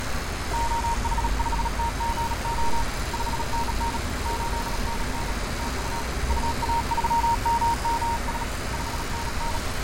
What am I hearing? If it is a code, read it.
Morse code, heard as a keyed tone, hand-sent with a bug key, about 37 wpm, 930 Hz, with heavy radio static, fading and street noise. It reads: OH5TGO 5NN 8NN TU UA3MMS 5NN